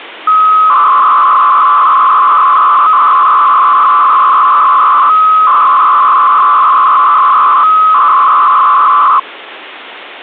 300-baud modem data (Bell 103 tones), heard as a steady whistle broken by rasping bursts, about 300 baud, 200 Hz shift, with phone line noise.